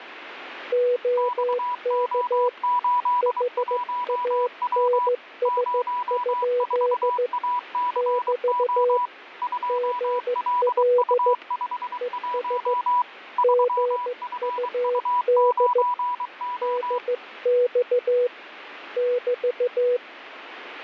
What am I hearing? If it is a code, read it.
Morse code, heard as two keyed tones, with radio static and static crashes. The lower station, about 15 wpm, 490 Hz: OK HANS? <BT> GL ES GUD DX <BT>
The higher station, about 23 wpm, 980 Hz: XO81W 04ACO 2LU51 3FU9O